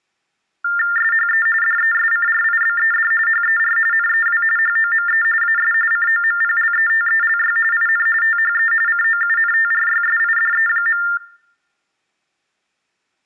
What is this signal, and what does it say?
TTY/TDD text telephone tones (45.45 baud Baudot), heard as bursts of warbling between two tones, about 400 Hz shift, 1600 Hz centre, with room echo. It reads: SHE DESCRIBED HER NEW HOME AS COMPLETELY IN THE COUNTRYSIDE.